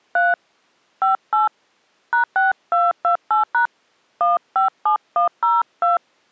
DTMF, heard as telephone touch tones, dialled by hand, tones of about 150 ms. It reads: 3 58 #6228# 157102